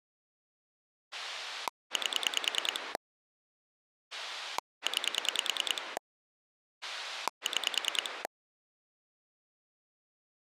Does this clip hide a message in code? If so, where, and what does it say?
Yes: pulse dialling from 1.1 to 8.3 s, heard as a rotary dial, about 10 pulses a second. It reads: 8 9 6